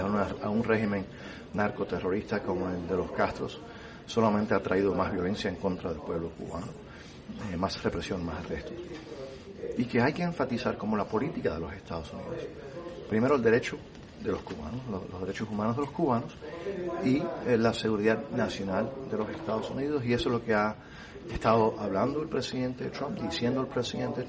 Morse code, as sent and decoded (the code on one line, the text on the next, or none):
none